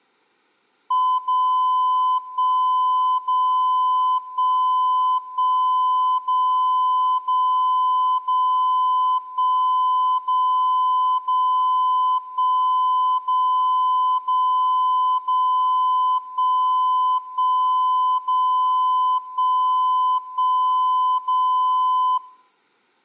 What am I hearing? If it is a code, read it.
Radio time signal (DCF77), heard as a tone whose level steps once a second, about 1010 Hz, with room echo. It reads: 0 1 0 1 1 0 0 0 1 0 0 1 0 0 0 1 1 0 1 1 0